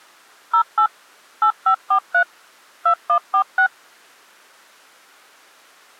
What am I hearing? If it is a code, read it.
DTMF, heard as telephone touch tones, dialled by machine, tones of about 90 ms. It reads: 08 8543 2146